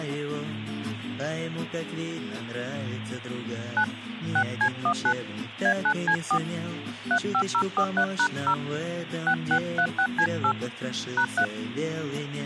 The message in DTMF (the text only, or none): 9 6C19 A9C4 35043#0 6636C8 #3